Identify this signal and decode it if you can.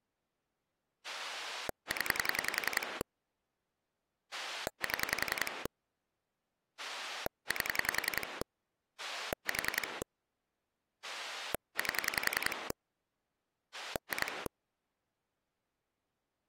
Pulse dialling, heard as a rotary dial, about 10 pulses a second. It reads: 0 7 8 4 8 2